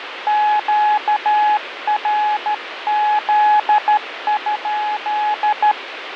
Morse code, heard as a keyed tone, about 13 wpm, 840 Hz, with radio static and fading. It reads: QRZ?